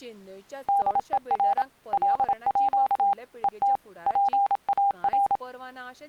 Morse code (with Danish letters), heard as a keyed tone, machine-sent, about 27 wpm, 800 Hz, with speech in Goan Konkani. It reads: DER LÅ ET PAR